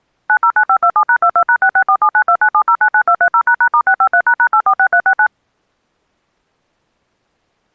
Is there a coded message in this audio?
Yes: DTMF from 0.3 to 5.3 s, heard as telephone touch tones, dialled by machine, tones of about 70 ms. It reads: 909527#22#66479297099230##*653##846369